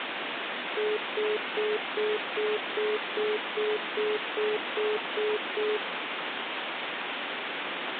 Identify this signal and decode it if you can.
Telephone call progress tone (single-tone plan, as in most of Europe), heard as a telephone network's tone, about 420 Hz, 0.2 s on and 0.2 s off, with phone line noise. Congestion tone.